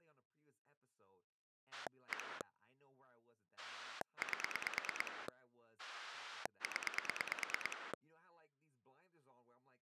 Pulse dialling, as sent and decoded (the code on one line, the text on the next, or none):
1 / 8 / 10
1 8 0